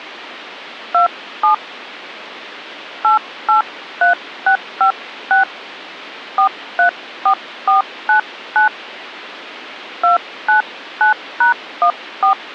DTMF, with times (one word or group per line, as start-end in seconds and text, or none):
0.9-1.5 27
3.0-5.4 883656
6.4-8.7 434499
10.0-12.3 299#14